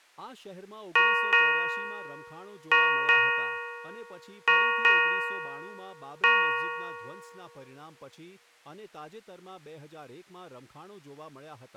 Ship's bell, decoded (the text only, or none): 7